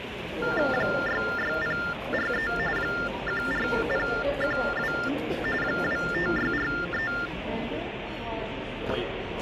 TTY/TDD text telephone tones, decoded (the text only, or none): 66043 14012 25643